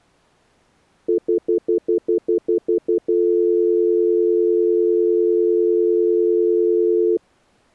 Telephone call progress tone (North American plan), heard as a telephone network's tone, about 350, 440 Hz, 0.1 s on and 0.1 s off. Stutter dial tone.